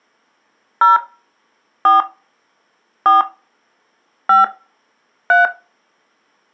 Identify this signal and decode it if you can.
DTMF, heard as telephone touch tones, dialled by hand, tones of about 150 ms. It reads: 0 4 4 5 3